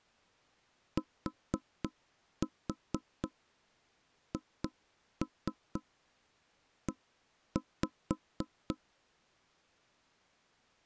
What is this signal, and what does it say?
Tap code, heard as knocks on wood, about 4 knocks a second. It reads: THE